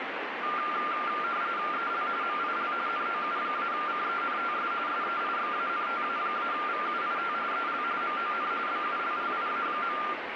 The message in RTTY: EL MIL NOU-CENTS SEIXANTA-VUIT EL MON BULLIA.

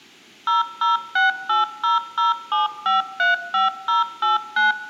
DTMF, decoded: 0068007535089

